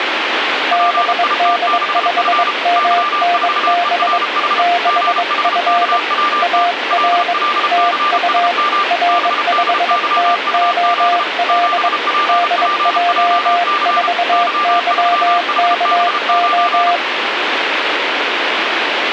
Morse code, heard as two keyed tones, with radio static. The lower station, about 22 wpm, 700 Hz: BD5MNB 6F AR TU R5TOL DJ4YKO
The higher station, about 33 wpm, 1190 Hz: PIT6F Y4ERH GHKWT LLCSM BDYUZ 7PPJC Y3HB9